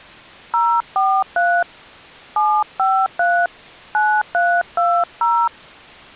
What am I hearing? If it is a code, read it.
DTMF, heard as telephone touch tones, dialled by hand, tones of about 270 ms. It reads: 043 753 9320